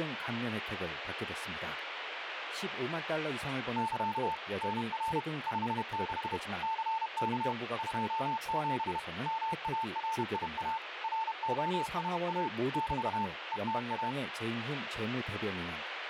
Morse code, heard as a keyed tone, machine-sent, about 31 wpm, 890 Hz, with radio static and speech in Korean. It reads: <KA> NR 56 CK 27 MARIA ROSA <BT> ETA